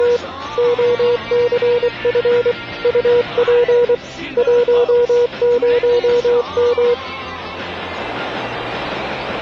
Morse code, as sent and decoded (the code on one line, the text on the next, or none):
… / --- -.-. ..-. / ..- .--. / .---- ----- --
… OCF UP 10M